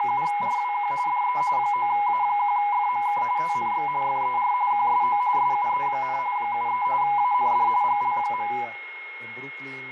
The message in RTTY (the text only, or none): … DE 9A1FMK TNX FER QSO SUE, 73 AND GL.